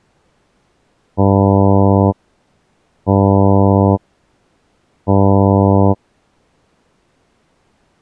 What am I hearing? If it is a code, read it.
Ship horn signal, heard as a ship's horn, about 100 Hz. 3 short. At sea: I am operating astern propulsion.